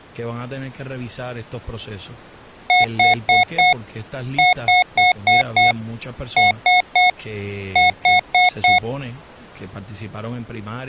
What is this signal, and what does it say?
Beep code, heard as beeps from a small speaker, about 730 Hz, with speech in Spanish. 4-5-3-4.